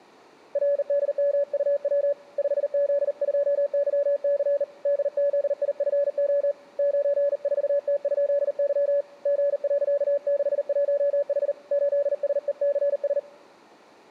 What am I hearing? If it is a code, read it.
Morse code, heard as a keyed tone, hand-sent with a bug key, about 39 wpm, 570 Hz. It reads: RDMUW 5Z2YC DZIFO 94T?Y G.61H 8SECS